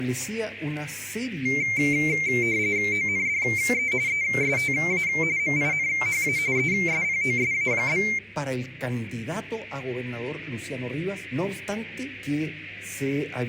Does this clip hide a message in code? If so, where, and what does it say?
Yes: RTTY (45.45 baud, 170 Hz shift) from 1.5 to 8.2 s, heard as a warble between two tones, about 2200 Hz centre. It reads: ONDE ESTA MINHA ESPOSA?